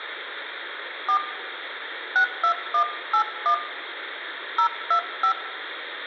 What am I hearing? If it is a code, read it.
DTMF, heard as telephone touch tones, dialled by hand, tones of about 90 ms, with phone line noise and room echo. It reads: 4 62181 025